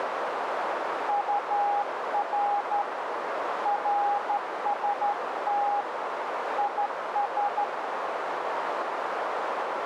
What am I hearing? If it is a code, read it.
Morse code, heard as a keyed tone, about 13 wpm, 820 Hz, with radio static and a narrow filter. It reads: UR RST IS